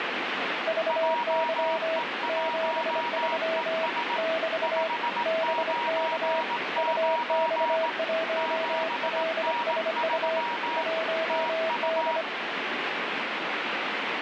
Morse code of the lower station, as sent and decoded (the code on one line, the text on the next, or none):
...- -.-- / --... ...-- / -...- / -... -.- / ..- -..- .---- .-.. ... ..- / .---- -..
VY 73 <BT> BK UX1LSU 1D